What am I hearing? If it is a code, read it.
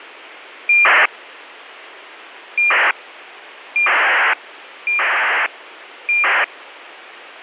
ACARS aircraft data, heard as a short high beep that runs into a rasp, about 2400 baud, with radio hiss.